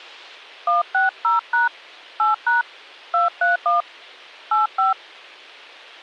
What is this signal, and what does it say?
DTMF, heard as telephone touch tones, dialled by hand, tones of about 150 ms. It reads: 160# 8# 231 85